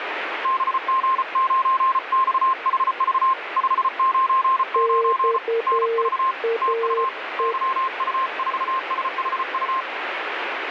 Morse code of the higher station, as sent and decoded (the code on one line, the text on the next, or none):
-... --. ----. -..- .... ...- / ..... ----. ----. / -. ...- / - ..- / -.-- ..- ....- ... .... ..-
BG9XHV 599 NV TU YU4SHU